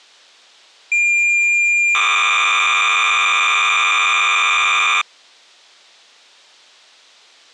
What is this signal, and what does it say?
Cassette data (Kansas City type), 300 baud, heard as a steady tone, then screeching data.